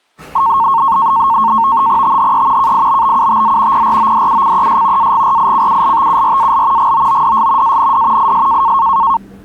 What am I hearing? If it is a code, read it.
NAVTEX (SITOR-B), 100 baud, 170 Hz shift, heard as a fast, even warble, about 1000 Hz centre, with the noise of a restaurant. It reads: THE KIBBUTZ PRODUCES AGRICULTURAL GOODS AND IS